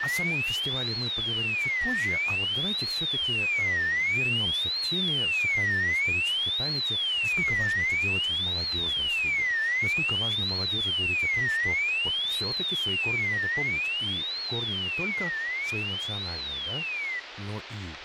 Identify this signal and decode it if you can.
A tone that sweeps in pitch again and again, with radio static and speech in Russian. There is no code.